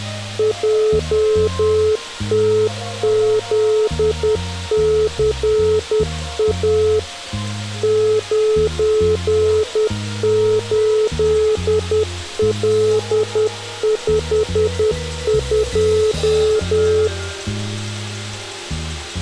Morse code, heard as a keyed tone, machine-sent, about 10 wpm, 430 Hz. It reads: JTZCA 98L52